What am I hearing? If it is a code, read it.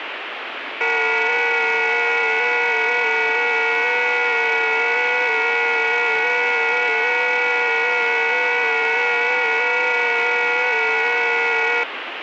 FT8 (several signals at once), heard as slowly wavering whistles, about 6.25 baud, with radio static.